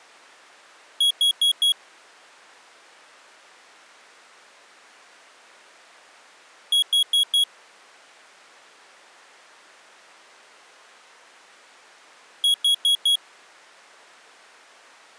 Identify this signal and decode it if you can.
Alarm pattern, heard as an alarm's beeps, played three times, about 3300 Hz. Temporal four. Carbon monoxide.